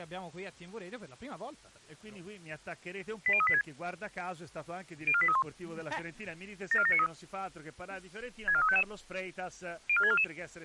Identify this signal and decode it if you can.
Five-tone selective call (ZVEI), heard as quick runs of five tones, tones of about 70 ms. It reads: 80386 04831 74793 64355 04644